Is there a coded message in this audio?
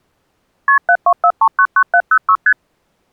Yes: multi-frequency trunk signalling (R1, as on North American trunks) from 0.7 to 2.5 s, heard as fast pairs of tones, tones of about 70 ms. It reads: KP 724399706 ST